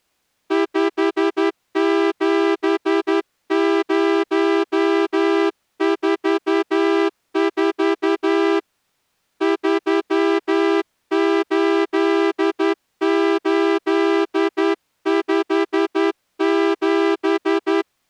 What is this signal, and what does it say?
Morse code, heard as a horn, hand-sent with a straight key, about 11 wpm. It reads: 57044 38857